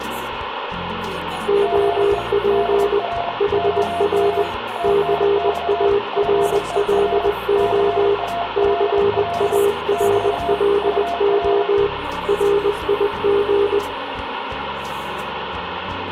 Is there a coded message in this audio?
Yes: Morse code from 1.4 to 13.8 s, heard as two keyed tones, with radio static and room echo. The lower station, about 20 wpm, 400 Hz: OP HR CARLO CARLO RIG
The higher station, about 27 wpm, 690 Hz: GE DR OM TNX FER CALL <BT> UR